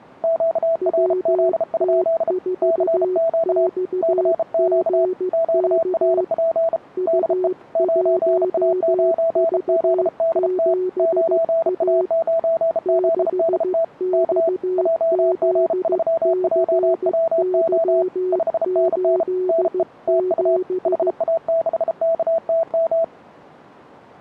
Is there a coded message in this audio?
Yes: Morse code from 0.2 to 23.1 s, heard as two keyed tones. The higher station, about 33 wpm, 660 Hz: QRZ? CQ CQ QRP DE 9A9ZDT 9A9ZDT K JG3JWO 5NN NE TU HA6KTM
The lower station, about 15 wpm, 370 Hz: WT4XGK U1V7A 6XZCY87